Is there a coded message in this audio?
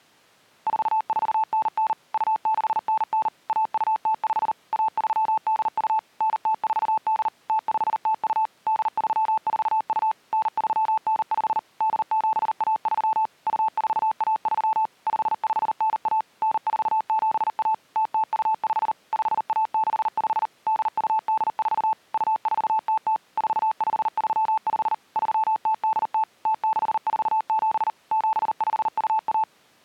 Yes: Morse code (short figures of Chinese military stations) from 0.6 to 29.5 s, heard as a keyed tone, machine-sent, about 39 wpm, 880 Hz. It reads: 4499 2699 1205 1382 9048 0502 8342 9395 8713 2413 5591 9471 0025 5165 8284 2400 4535 3080 0647 7521